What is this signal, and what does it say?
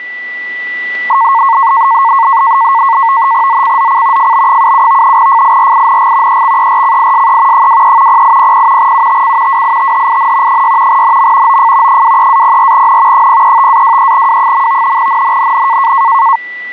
NAVTEX (SITOR-B), 100 baud, 170 Hz shift, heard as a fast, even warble, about 1000 Hz centre, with static crashes and a steady whistle near 1970 Hz. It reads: ZCZC FB77 FIRING EXERCISE 23 0800 UTC WITHIN 6 NM OF 23-04N 035-23W. NNNN